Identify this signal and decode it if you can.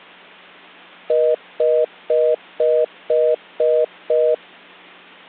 Telephone call progress tone (North American plan), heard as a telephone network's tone, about 480, 620 Hz, 0.25 s on and 0.25 s off. Congestion tone.